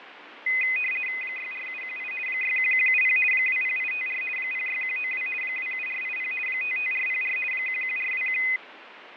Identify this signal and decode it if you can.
RTTY (50 baud, 450 Hz shift), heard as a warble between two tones, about 2250 Hz centre, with radio static and fading. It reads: 64718 61170 20854 06192 27480 55404 11421